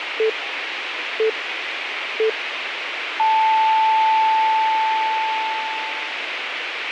Radio time signal (three low pips and a long one an octave up, as on NHK), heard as pips, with radio hiss.